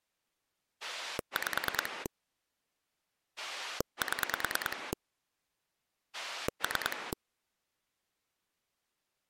Pulse dialling, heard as a rotary dial, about 9 pulses a second. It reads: 5 7 3